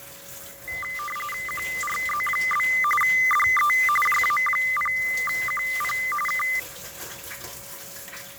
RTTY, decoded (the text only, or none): QRZ? DE JA0QP K